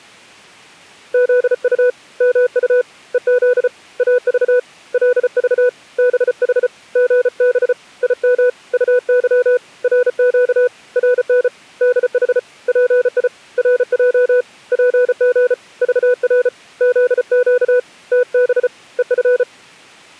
Morse code, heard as a keyed tone, hand-sent with a paddle, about 34 wpm, 500 Hz. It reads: ZU MU EZ AV LV BH GB IM UY RQ RN DH PI RJ PG VR ZQ TB EF